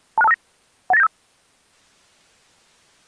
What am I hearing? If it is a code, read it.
Five-tone selective call (EIA), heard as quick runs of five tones, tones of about 30 ms. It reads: 26259 18975